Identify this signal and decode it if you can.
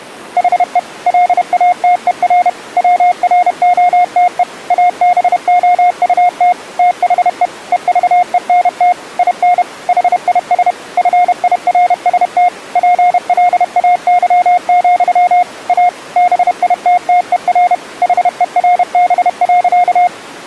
Morse code, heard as a keyed tone, machine-sent, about 31 wpm, 720 Hz. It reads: HE LATER WROTE ABOUT THE EVENT IN HIS FIRST PLAY, A BITTER HERB.